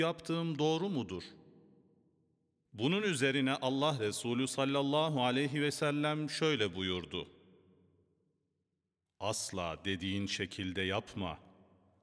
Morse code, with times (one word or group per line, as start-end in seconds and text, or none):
none